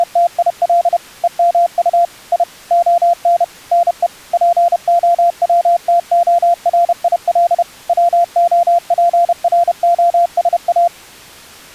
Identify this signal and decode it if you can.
Morse code (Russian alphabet), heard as a keyed tone, machine-sent, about 31 wpm, 690 Hz. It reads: … ЕМУ И ОН НЕ ПОВТОРИЛ ВОПРОСА